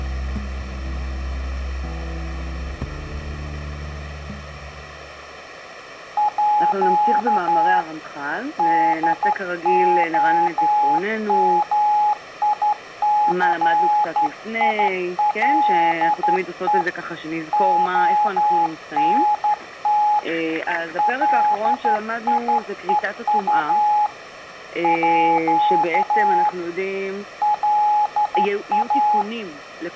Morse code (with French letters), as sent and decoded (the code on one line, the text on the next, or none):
.--.- / -.. --- -- .. -.-. .. .-.. . / --- -. - / .-.. .. . ..- / .--.- / .-.. .-
À DOMICILE ONT LIEU À LA